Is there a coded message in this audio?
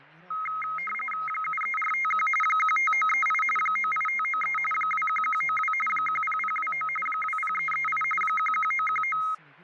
Yes: RTTY (45.45 baud, 850 Hz shift) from 0.3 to 9.3 s, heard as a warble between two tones, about 1700 Hz centre, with fading and speech in Italian. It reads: 73451 15938 98593 21192 10029 20338 11919